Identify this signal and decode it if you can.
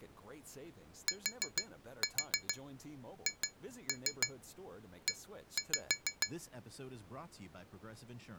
Tap code, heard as taps on glass, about 6 knocks a second, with speech in English. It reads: THE